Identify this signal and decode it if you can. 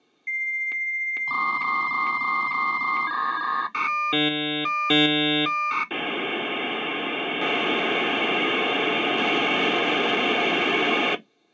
Dial-up modem handshake (V.34 or later), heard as a whistle, warbles, then hiss.